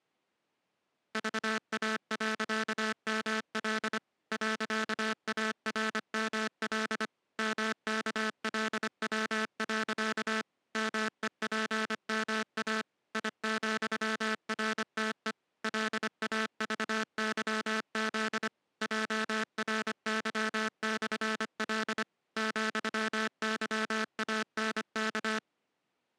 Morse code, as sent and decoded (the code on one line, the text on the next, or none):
...- .- .-.-.- -- .-.. / .-.-.- .- .-. -- .-.. / -- -.- .-.. .-- .-.-.- / -- . .--. -- .- / .. --..-- .-. - . / .-.. .- ...- -.-- --.. / .--- .-. -.-- -..-. .-.. / --..-- -.-- .- -. -.-
VA.ML .ARML MKLW. MEPMA I,RTE LAVYZ JRY/L ,YANK